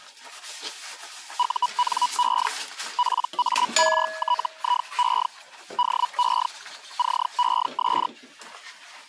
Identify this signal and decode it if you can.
Hellschreiber (Feld-Hell, 122.5 baud), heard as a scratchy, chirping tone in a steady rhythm, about 980 Hz, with kitchen noise. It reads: UNE PARTIE DE CES